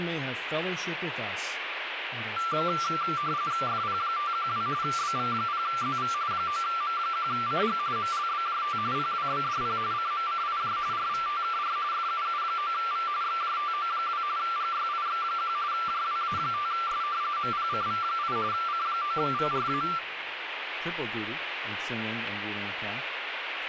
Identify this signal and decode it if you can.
RTTY (45.45 baud, 170 Hz shift), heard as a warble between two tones, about 1260 Hz centre, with radio static. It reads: FP512 BV0ZV 9M1CG MLBJT PWBDP CMCIJ RVTKR FUU9V XJTO2 GYIX1 JWA5S MPCV8 C9VRA